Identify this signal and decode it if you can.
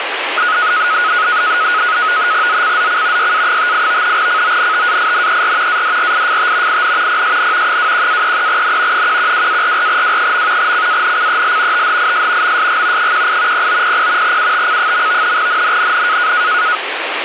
NAVTEX (SITOR-B), 100 baud, 170 Hz shift, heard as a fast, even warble, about 1360 Hz centre, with radio static. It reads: ZCZC YA58 CONTAINER ADRIFT IN PSN 21-33N 112-44W. CANCEL THIS MSG 18 0900 UTC. NNNN